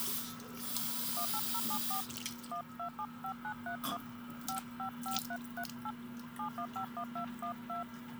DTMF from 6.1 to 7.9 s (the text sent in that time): 7151212